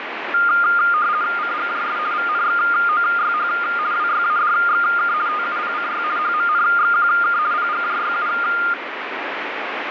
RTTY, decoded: CGJS VNXOYH WYADXK TUPCY HMNXQK PGJYU

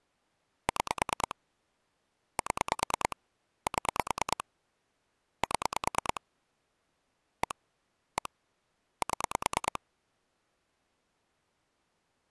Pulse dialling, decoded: 6 7 7 7 1 1 7

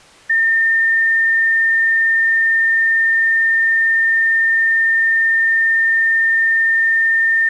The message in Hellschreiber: none

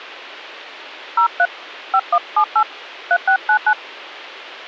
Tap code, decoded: none

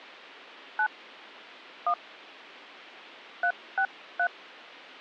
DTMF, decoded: 9 1 363

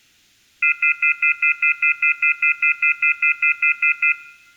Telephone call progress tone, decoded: off-hook warning tone

